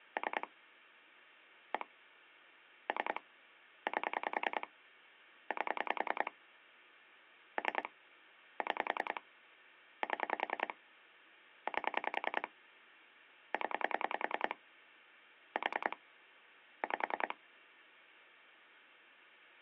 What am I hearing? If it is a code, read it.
Pulse dialling, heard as clicks on a phone line, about 10 pulses a second, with hum. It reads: 3 1 3 8 8 3 6 7 8 0 4 5